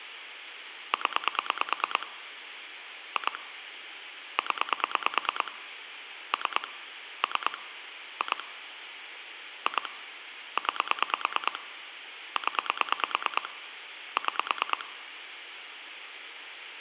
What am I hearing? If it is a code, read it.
Pulse dialling, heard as clicks on a phone line, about 9 pulses a second. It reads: 0 2 0 3 3 2 2 9 0 6